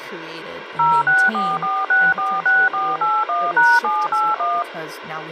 DTMF, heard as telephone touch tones, dialled by machine, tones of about 220 ms, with radio hiss and speech in English. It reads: 0644646481#781